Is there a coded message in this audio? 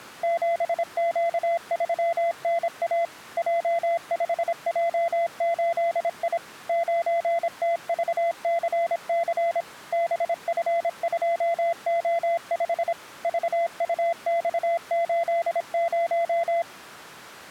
Yes: Morse code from 0.2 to 16.7 s, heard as a keyed tone, machine-sent, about 26 wpm, 680 Hz. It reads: 7Q3NA J5J8I 9TVCC BF2O5 VUX80